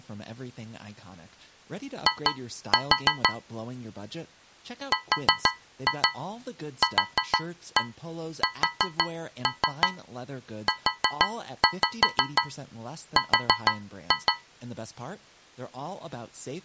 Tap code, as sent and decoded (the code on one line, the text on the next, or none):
2-4 / 4-2 4-1 4-3 4-5 4-2
I RQSUR